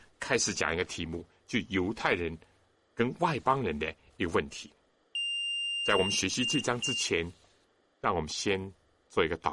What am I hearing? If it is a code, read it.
Beep code, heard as a piezo beeper, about 2800 Hz, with room echo and speech in Chinese. 1 long, 2 short. In Award, IBM and AMI BIOS tables: video adapter failure.